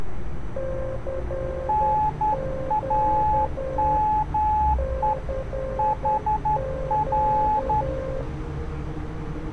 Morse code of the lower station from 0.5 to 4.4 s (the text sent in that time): CQ